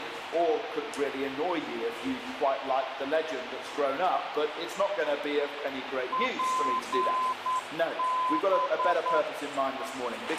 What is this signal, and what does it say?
Morse code, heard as a keyed tone, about 9 wpm, 1020 Hz, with radio hiss and a squelch burst at the end. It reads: PB